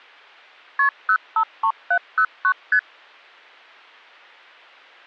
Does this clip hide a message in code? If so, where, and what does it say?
Yes: multi-frequency trunk signalling (R1, as on North American trunks) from 0.8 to 2.8 s, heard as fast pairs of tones, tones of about 70 ms. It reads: KP 053709 ST